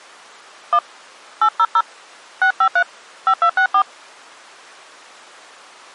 DTMF, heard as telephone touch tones, dialled by hand, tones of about 80 ms. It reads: 1 800 653 5264